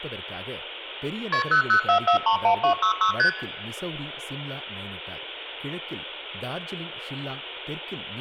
Multi-frequency trunk signalling (R1, as on North American trunks), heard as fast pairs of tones, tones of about 100 ms, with speech in Tamil. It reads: KP 004431266 ST